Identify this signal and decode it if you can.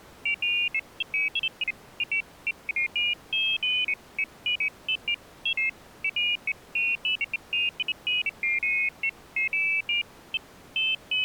Pairs of high tones at irregular times. There is no code.